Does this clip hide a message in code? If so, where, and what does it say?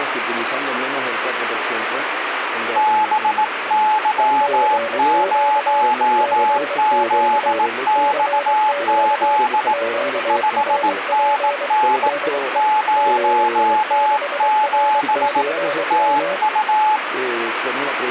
Yes: Morse code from 2.7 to 17.0 s, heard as two keyed tones, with radio static. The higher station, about 18 wpm, 860 Hz: BY0ZXZ 5NN 07 TU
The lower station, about 23 wpm, 570 Hz: CQ CQ CQ QRP DE GI6R/M